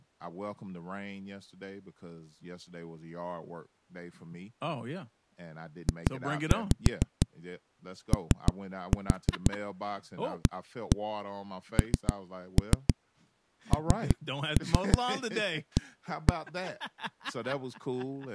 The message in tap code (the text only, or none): JOANNA